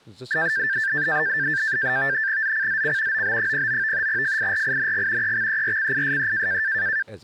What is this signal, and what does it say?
NAVTEX (SITOR-B), 100 baud, 170 Hz shift, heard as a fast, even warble, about 1700 Hz centre, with speech in Kashmiri. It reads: ZCZC OB09 FIRING EXERCISE